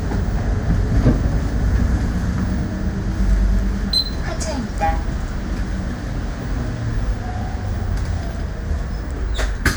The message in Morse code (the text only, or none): none